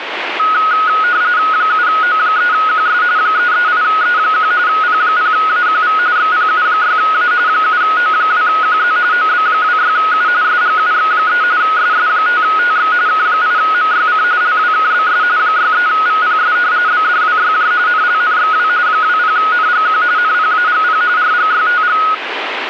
RTTY (45.45 baud, 170 Hz shift), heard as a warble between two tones, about 1360 Hz centre, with radio static. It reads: 7O3QS 338E1 P0AQV XPU6A 7O2QZ OB26U SGUX3 SS5TX K8MYC LWKBS 63VPS BDWYJ NLNXW 20NGQ NPAGP RGYTG